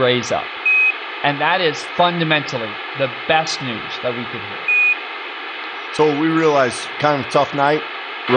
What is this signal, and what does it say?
Quindar tones, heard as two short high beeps, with radio hiss, a squelch burst at the end and speech in English.